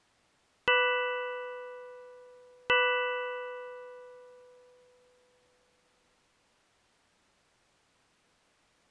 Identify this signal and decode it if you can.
Clock strike, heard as a bell. 2. Two o'clock.